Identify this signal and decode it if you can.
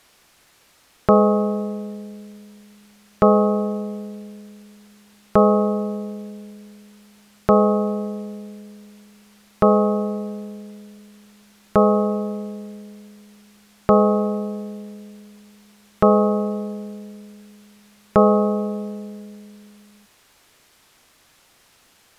Clock strike, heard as a bell. 9. Nine o'clock.